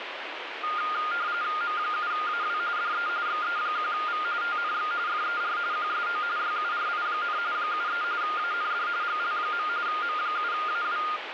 RTTY (45.45 baud, 170 Hz shift), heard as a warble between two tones, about 1320 Hz centre, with radio static. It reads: M7AW DE XE1V TNX FER QSO YURI, 73 AND GL. M7AW